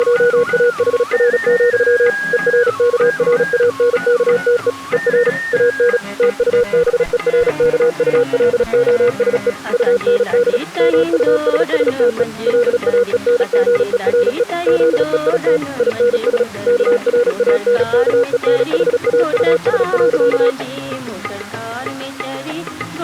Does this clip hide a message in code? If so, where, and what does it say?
Yes: Morse code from 0.0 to 20.6 s, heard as a keyed tone, machine-sent, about 36 wpm, 480 Hz. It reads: … ERKRANKTE ER AN TUBERKULOSE UND MUSSTE LAENGERE ZEIT INS KRANKENHAUS.